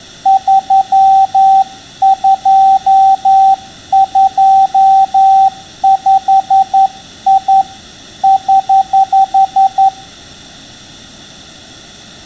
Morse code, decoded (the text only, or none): 3225I <HH>